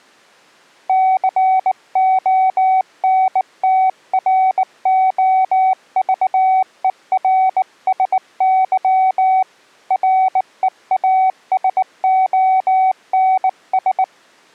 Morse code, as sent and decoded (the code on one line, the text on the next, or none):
-.-. --- -. - .-. --- ...- . .-. ... -.-- / .-. . .- ... --- -. ...
CONTROVERSY REASONS